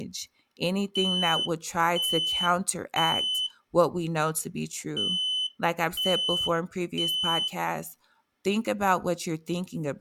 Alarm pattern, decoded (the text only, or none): temporal three